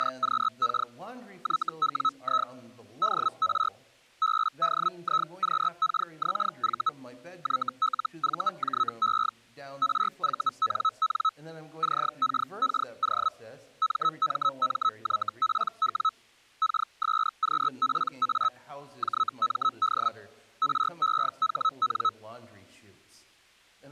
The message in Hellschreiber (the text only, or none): … YWI DR BDIQKXV YLVJE RVNN CKKO MMMYPW KSQPA JMD REHN